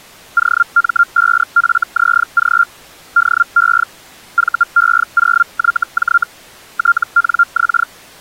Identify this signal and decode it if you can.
Hellschreiber (Feld-Hell, 122.5 baud), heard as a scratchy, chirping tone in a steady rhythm, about 1390 Hz. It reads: OM5FZG DE VE0YJ TNX